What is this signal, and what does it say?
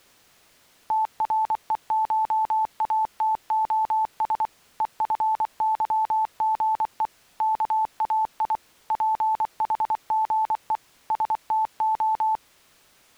Morse code (Greek alphabet), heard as a keyed tone, machine-sent, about 24 wpm, 880 Hz. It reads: ΤΡΕΧΑΤΟΣ ΕΦΥΓΕ ΚΑΙ ΠΗΓΕ ΣΤΟ